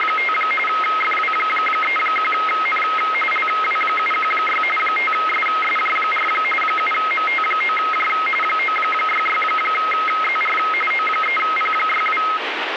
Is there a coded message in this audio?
Yes: RTTY (45.45 baud, 850 Hz shift) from 0.0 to 12.4 s, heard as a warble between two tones, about 1700 Hz centre, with radio static. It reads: … FW31N LW716 5SSJ4 7MT9J 966ZR O3P62